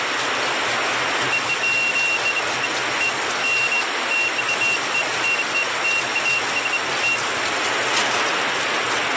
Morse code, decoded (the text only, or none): none